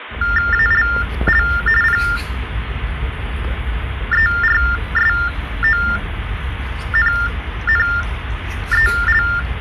TTY/TDD text telephone tones (45.45 baud Baudot), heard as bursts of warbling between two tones, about 400 Hz shift, 1600 Hz centre, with phone line noise and the noise of a park. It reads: ALL PERSONNEL